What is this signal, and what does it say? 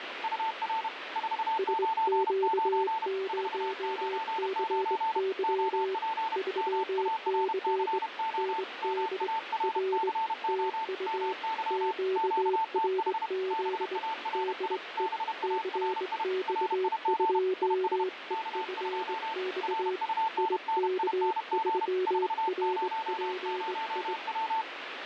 Morse code, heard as two keyed tones, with radio static. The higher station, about 31 wpm, 890 Hz: UR 499 499 OP MARCO MARCO MY QTH BARI BARI RIG IS K2 RUNNING 400W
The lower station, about 21 wpm, 380 Hz: SQ0CY 3C ND R TU QRZ DE CX2EFX IK3RPI